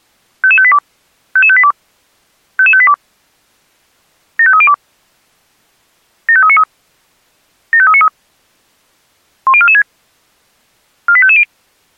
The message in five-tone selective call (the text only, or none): 55582 55582 55582 75302 75393 75393 10446 48550